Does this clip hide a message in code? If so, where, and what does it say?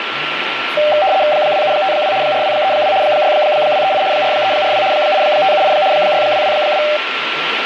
Yes: RTTY (75 baud, 170 Hz shift) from 0.8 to 7.0 s, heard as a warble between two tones, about 690 Hz centre, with radio static, a steady whistle near 1360 Hz and speech in Urdu. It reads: 2752 4232 6238 4342 8578 6222